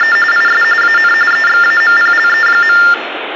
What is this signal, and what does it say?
TTY/TDD text telephone tones (45.45 baud Baudot), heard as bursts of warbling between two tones, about 400 Hz shift, 1600 Hz centre, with phone line noise and room echo. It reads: … IS AN EXAMPLE.